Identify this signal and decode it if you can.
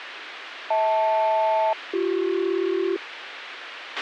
Aircraft SELCAL, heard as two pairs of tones, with radio hiss and a squelch burst at the end. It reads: HL-BC